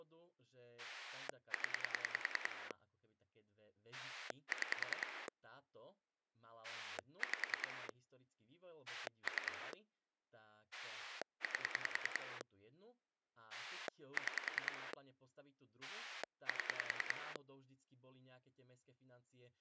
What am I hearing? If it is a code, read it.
Pulse dialling, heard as a rotary dial, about 10 pulses a second, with speech in Slovak. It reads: 0 6 5 3 8 6 7